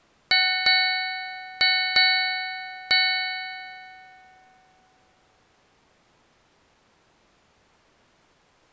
Ship's bell, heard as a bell. 5. Five half-hours of the watch have passed.